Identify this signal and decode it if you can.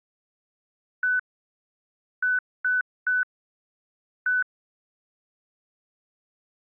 Beep code, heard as beeps, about 1500 Hz. 1-3-1. In Phoenix BIOS tables: memory refresh failure.